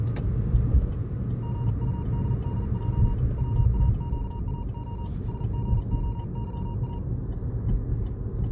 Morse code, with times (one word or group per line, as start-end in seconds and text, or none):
1.4-3.1 GUDDJ
3.4-5.1 WAQAO
5.3-7.0 SGOYA